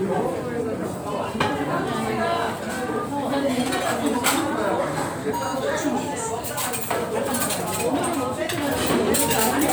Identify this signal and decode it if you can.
The noise of a restaurant. There is no code.